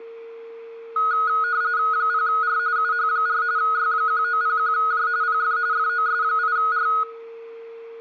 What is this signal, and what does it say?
RTTY (45.45 baud, 170 Hz shift), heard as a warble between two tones, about 1360 Hz centre, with a steady whistle near 460 Hz and room echo. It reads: 0R UH4 Y1901J PF FOS8R